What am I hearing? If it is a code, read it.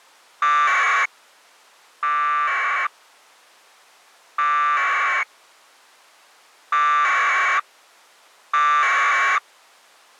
Packet radio (AX.25, as in APRS), 1200 baud, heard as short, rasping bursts.